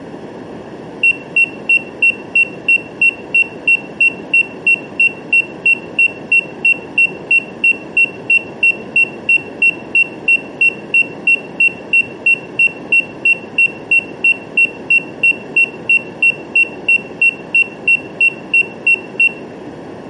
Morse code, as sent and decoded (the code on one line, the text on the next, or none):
none